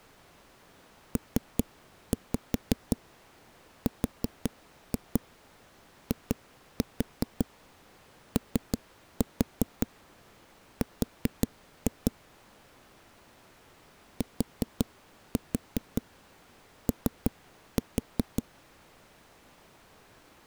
Tap code, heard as knocks on a wall, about 5 knocks a second. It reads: PRIOR TO